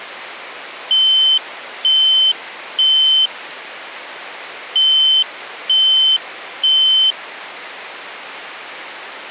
Alarm pattern, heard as an alarm's beeps, played twice, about 3100 Hz. Temporal three. Smoke or fire, evacuate.